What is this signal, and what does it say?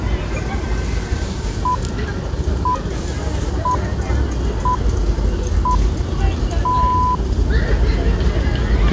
Radio time signal (six pips, as the Greenwich Time Signal), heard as pips, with the noise of a residential street.